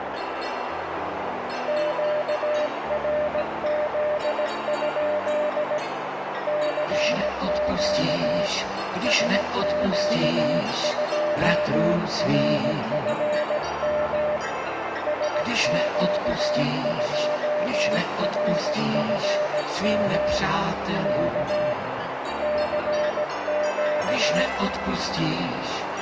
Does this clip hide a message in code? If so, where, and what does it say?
Yes: Morse code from 1.6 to 24.5 s, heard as a keyed tone, hand-sent with a paddle, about 17 wpm, 600 Hz, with radio static and a narrow filter. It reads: QRZ? CQ SQ2RFM SQ2RFM K CQ